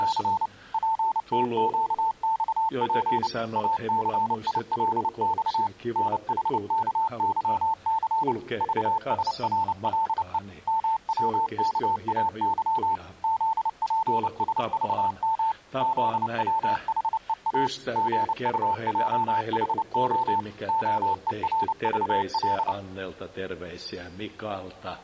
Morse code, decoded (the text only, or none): … PTQXP ACILX NHKYC VSRLE MWKAY ZPSVM ZWHEA GUJHO OERVL